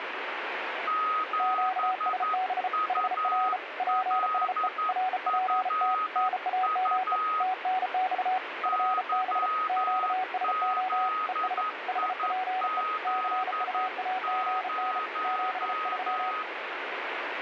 Morse code, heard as two keyed tones, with heavy radio static. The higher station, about 11 wpm, 1260 Hz: 7ULFU YZIZ0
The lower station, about 34 wpm, 750 Hz: QSB HR PSE RPT NAME TNX FB QSO ES HPE CUAGN 73